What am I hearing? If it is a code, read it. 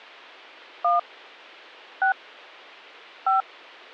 DTMF, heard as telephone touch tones, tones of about 120 ms. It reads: 1 6 5